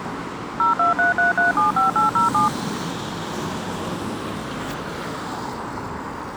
DTMF, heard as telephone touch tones, dialled by machine, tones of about 140 ms, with street noise. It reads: 0233375807